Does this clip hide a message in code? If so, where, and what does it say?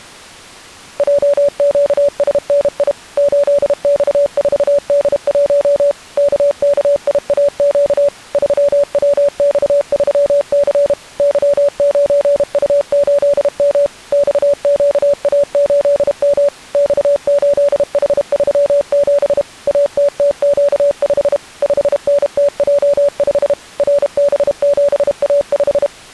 Yes: Morse code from 0.9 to 25.9 s, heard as a keyed tone, machine-sent, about 32 wpm, 570 Hz. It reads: JQSNI 8X4D1 KKIAQ 3WX3C Y9U8M XQA8M X8H37 ATTQ5 5NTJ5 RB7A5